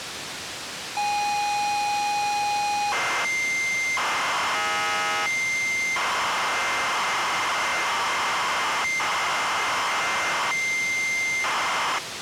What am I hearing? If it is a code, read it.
ZX Spectrum tape loading, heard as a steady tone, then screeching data, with tape hiss.